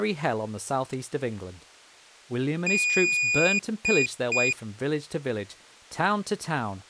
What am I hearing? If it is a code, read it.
Beep code, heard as a piezo beeper, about 2450 Hz, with speech in English. 1 long, 2 short. In Award, IBM and AMI BIOS tables: video adapter failure.